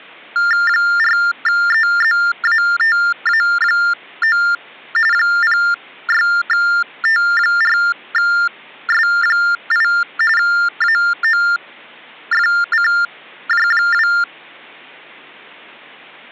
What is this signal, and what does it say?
TTY/TDD text telephone tones (45.45 baud Baudot), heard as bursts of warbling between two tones, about 400 Hz shift, 1600 Hz centre. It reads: 4EZATA9 06T4S8 AOFCJ2